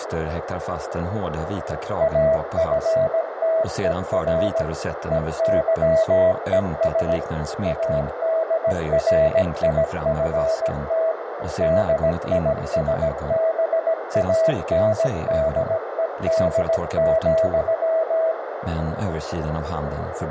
Morse code, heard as a keyed tone, machine-sent, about 17 wpm, 650 Hz, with radio static and a narrow filter. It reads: AFTER EYES ADRIFT DISBANDED,